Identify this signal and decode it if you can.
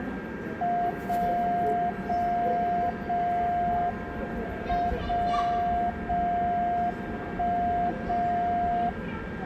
Radio time signal (WWVB), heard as a tone whose level steps once a second, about 700 Hz, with a steady whistle near 1600 Hz, room echo and the noise of a subway station. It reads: 0 0 0 M 0 0 1 0